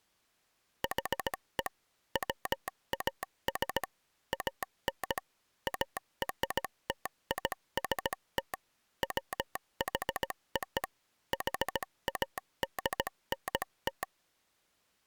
Morse code (American railroad code), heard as a telegraph sounder, machine-sent. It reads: HE WAS AN ARTIST WHO HADNT